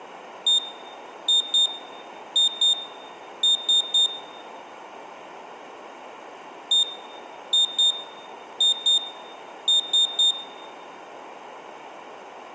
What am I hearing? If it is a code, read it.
Beep code, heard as a piezo beeper, played twice, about 3650 Hz, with room echo. 1-2-2-3. In Phoenix BIOS tables: BIOS ROM checksum failure.